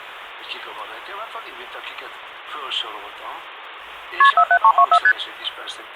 Multi-frequency trunk signalling (R1, as on North American trunks), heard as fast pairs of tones, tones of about 70 ms. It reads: KP 47324 ST